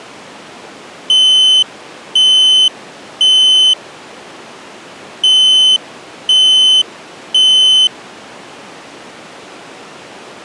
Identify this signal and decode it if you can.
Alarm pattern, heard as an alarm's beeps, played twice, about 3050 Hz. Temporal three. Smoke or fire, evacuate.